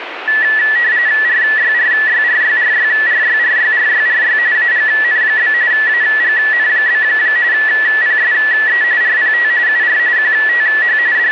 RTTY (45.45 baud, 170 Hz shift), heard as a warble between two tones, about 1850 Hz centre, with radio static. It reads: RYRYRYRYRYRYRYRY AGN? AGN? PSE RPT UR QTH …